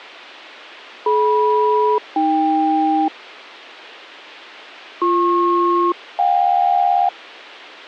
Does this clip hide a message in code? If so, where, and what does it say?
Yes: aircraft SELCAL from 1.1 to 7.1 s, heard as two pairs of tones, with a squelch burst at the end. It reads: DM-AK BP-JK